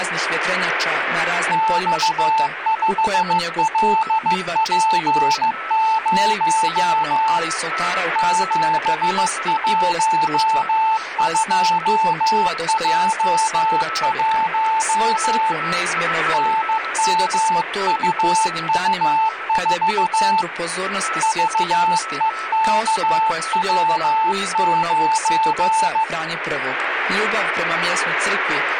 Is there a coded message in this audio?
Yes: Morse code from 1.5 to 26.1 s, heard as a keyed tone, hand-sent with a paddle, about 15 wpm, 880 Hz, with radio static and a weaker station near 1310 Hz. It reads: X5LP0 712J1 NMUU4 VEKW9